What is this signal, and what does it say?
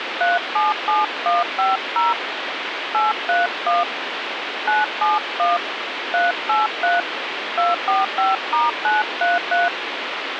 DTMF, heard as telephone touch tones, dialled by hand, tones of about 170 ms, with radio hiss. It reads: 377150 831 971 383 245*933